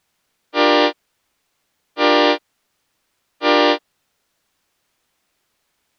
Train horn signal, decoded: 3 short

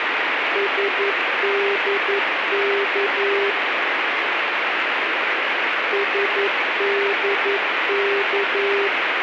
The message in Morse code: SDK SDK

